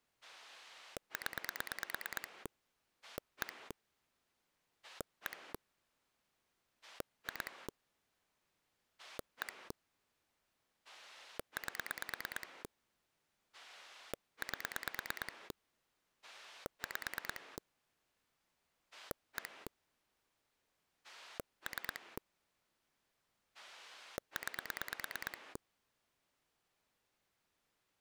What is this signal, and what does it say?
Pulse dialling, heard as a rotary dial, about 9 pulses a second. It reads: 0 1 1 2 1 8 8 5 1 3 9